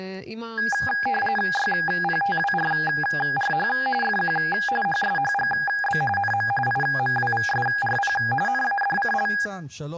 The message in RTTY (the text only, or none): YPTWRRH FQ HSHGB NM IMWVSRP NADCL